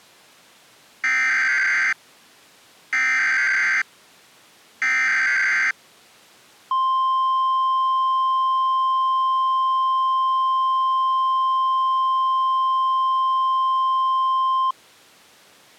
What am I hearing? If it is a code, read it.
Emergency Alert System (SAME) tones (header bursts, then the 1050 Hz attention tone), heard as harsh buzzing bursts, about 520.83 baud.